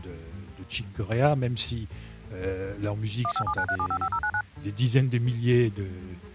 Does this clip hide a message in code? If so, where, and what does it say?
Yes: DTMF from 3.2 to 4.4 s, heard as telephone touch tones, dialled by machine, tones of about 70 ms. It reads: 15793755099